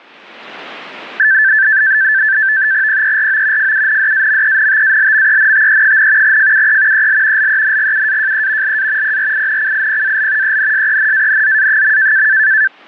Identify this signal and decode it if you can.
NAVTEX (SITOR-B), 100 baud, 170 Hz shift, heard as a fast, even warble, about 1650 Hz centre. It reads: PERO FUNDAMENTALMENTE, FUE EL LENGUAJE LA PRINCIPAL ENSENANZA.